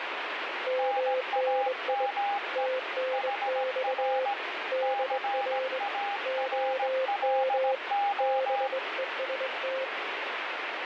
Morse code, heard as two keyed tones, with radio static. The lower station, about 22 wpm, 520 Hz: MNI TNX DR OM BEST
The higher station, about 17 wpm, 810 Hz: NAME HR CARLO